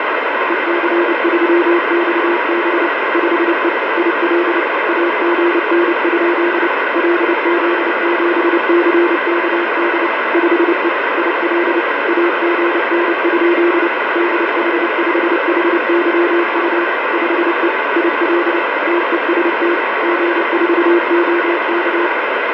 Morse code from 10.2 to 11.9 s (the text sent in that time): 5E IL